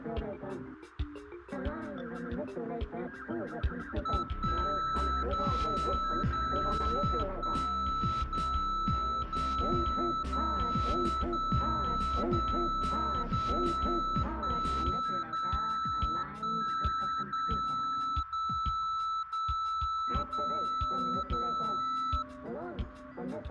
Radio time signal (DCF77), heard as a tone whose level steps once a second, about 1320 Hz. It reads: 1 0 0 1 0 0 0 0 0 0 1 0 1 0 0 0 0 0